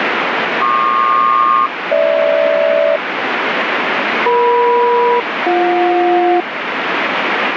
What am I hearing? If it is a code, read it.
Aircraft SELCAL, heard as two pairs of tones, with radio static. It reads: PQ-GH EM-BJ